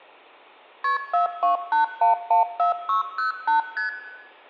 Multi-frequency trunk signalling (R1, as on North American trunks), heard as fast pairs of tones, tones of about 130 ms, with hum and room echo. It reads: KP 428114608 ST